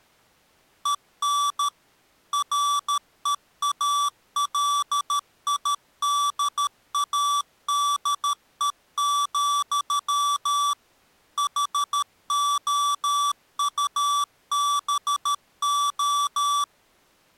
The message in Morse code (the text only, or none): EN REALIDADE, HOUBO